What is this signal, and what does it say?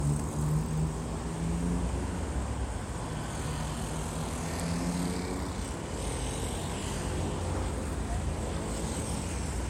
Street noise. There is no code.